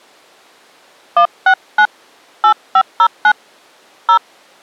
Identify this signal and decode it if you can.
DTMF, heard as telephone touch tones, dialled by hand, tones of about 80 ms. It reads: 169 8509 0